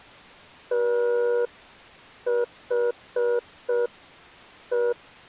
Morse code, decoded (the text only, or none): THE